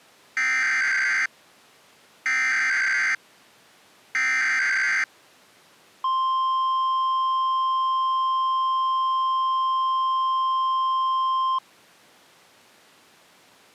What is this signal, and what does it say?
Emergency Alert System (SAME) tones (header bursts, then the 1050 Hz attention tone), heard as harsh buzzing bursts, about 520.83 baud.